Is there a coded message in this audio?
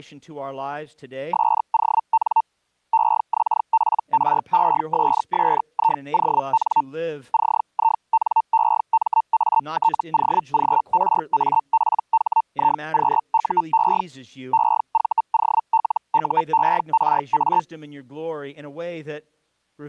Yes: Hellschreiber (Feld-Hell, 122.5 baud) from 1.3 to 17.6 s, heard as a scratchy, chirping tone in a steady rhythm, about 900 Hz. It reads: SON EXPRESSION CINEMATOGRAPHIQUE EVOLUERA